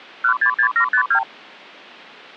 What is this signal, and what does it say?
Multi-frequency trunk signalling (R2, with the far end's replies), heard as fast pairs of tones, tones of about 90 ms. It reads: 166752